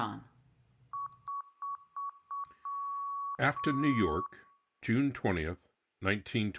Beep code, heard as beeps, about 1120 Hz, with room echo and speech in English. 5 short, 2 long.